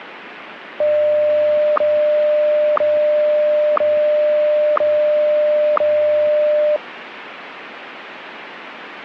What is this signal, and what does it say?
Radio time signal (WWVH, Hawaii), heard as ticks, one a second, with radio static.